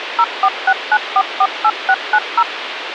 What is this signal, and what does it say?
DTMF, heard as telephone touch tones, dialled by machine, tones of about 60 ms, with radio hiss. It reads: 0469448690